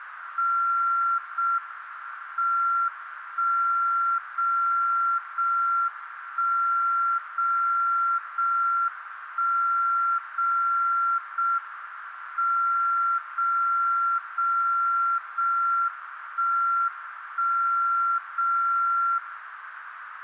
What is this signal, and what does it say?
Radio time signal (JJY), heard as a tone whose level steps once a second, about 1370 Hz, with radio static and a narrow filter. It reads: 0 M 1 0 0 1 0 0 1 0 0 M 0 0 0 1 1 0 0